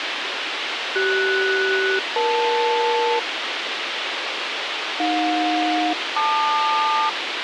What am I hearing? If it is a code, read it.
Aircraft SELCAL, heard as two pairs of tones, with radio hiss. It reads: CS-EL AJ-LQ